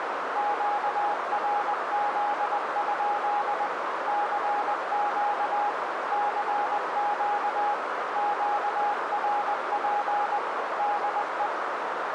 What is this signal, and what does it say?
Morse code, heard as a keyed tone, machine-sent, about 20 wpm, 820 Hz, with heavy radio static and a narrow filter. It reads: QRZ? CQ CQ QRP DE